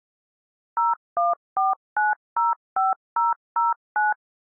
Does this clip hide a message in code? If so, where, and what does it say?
Yes: DTMF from 0.8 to 4.1 s, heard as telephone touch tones, dialled by machine, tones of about 170 ms. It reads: 014905009